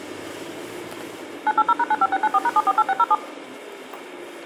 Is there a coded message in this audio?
Yes: DTMF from 1.5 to 3.1 s, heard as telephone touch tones, dialled by machine, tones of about 40 ms, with the noise inside a car. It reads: 980#95694#748607